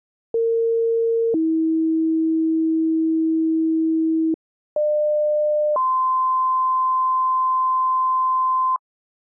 Two-tone page, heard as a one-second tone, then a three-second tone, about 460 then 320 Hz, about 600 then 1040 Hz.